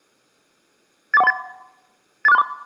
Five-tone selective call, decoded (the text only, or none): 84138 84634